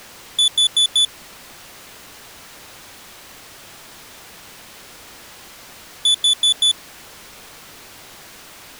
Alarm pattern, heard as an alarm's beeps, played twice, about 3450 Hz. Temporal four. Carbon monoxide.